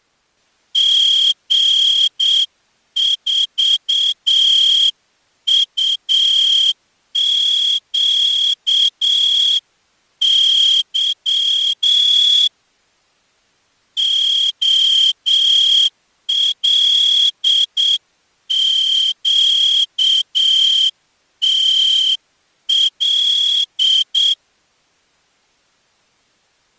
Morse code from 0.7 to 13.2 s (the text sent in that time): G4UQY